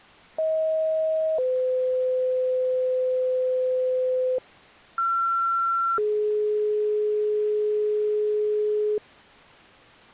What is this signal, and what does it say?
Two-tone page, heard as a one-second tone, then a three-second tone, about 630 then 510 Hz, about 1360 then 420 Hz.